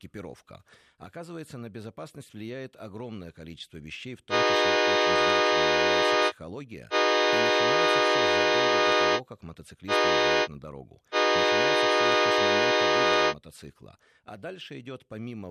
Train horn signal, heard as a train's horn, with speech in Russian. 2 long, 1 short, 1 long. On North American railways: approaching a public crossing.